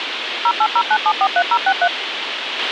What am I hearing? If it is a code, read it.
DTMF, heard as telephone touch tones, dialled by machine, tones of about 60 ms, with radio hiss and a squelch burst at the end. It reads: 0809743063